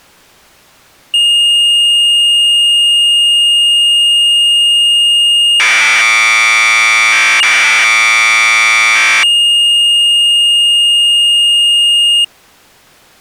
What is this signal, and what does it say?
Commodore tape loading (standard loader), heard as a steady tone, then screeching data.